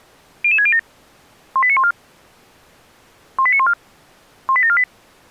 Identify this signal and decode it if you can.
Five-tone selective call (ZVEI), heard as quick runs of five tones, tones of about 70 ms. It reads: 00607 18914 18914 18748